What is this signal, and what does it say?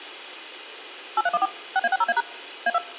DTMF, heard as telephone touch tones, dialled by machine, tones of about 40 ms, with a squelch burst at the end. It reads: 8314 6A60A# A2